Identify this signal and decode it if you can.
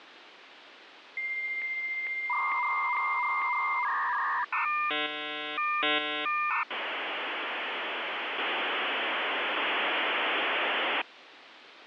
Dial-up modem handshake (V.34 or later), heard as a whistle, warbles, then hiss, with phone line noise.